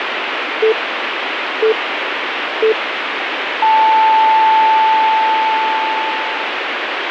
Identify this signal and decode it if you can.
Radio time signal (three low pips and a long one an octave up, as on NHK), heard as pips, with radio hiss.